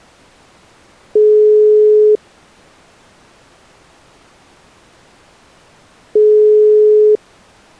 Telephone call progress tone (single-tone plan, as in most of Europe), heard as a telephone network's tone, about 420 Hz, 1 s on and 4 s off. Ringback tone.